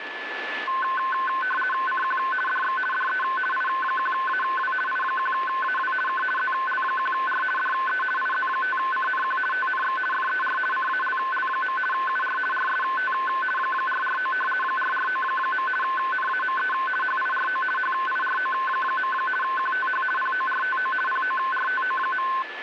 RTTY (50 baud, 450 Hz shift), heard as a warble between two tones, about 1280 Hz centre, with radio static and a steady whistle near 1740 Hz. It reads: CQ DX DE I1AW I1AW K ZL1R DE IZ5CNQ TNX FER CALL. UR RST 449 449. NAME HIRO HIRO. QTH PORTO PORTO.